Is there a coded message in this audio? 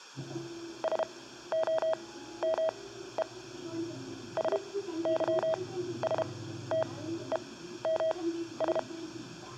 Yes: Morse code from 0.8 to 8.9 s, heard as a keyed tone, machine-sent, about 32 wpm, spaced as for 14 wpm, 640 Hz, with the noise inside a bus. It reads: SOME SYSTEMS